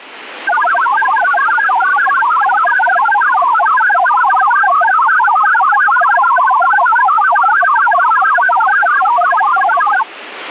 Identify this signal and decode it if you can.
Multi-tone FSK (Olivia or MFSK type), about 1000 Hz wide, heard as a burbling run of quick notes, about 62.5 baud, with radio static.